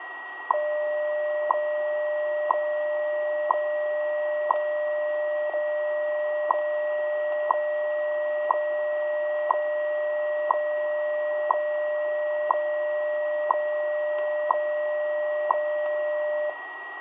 Radio time signal (WWV, Colorado), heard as ticks, one a second, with radio static, a steady whistle near 1910 Hz and room echo.